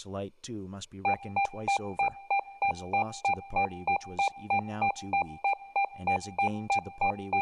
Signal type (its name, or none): none